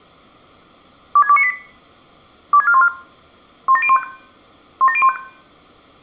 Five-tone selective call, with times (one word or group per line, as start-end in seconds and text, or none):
1.2-1.5 26298
2.5-2.9 26414
3.7-4.0 17015
4.8-5.2 17015